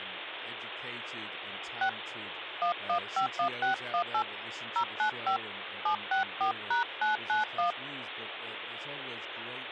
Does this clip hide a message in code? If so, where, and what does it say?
Yes: DTMF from 1.8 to 7.7 s, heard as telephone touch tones, dialled by hand, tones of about 110 ms, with phone line noise and speech in English. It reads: 6 1151618 095 764#991